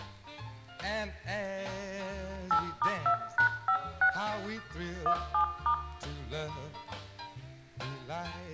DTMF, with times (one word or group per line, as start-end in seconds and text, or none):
2.5-4.1 8*2#56
5.1-5.7 17*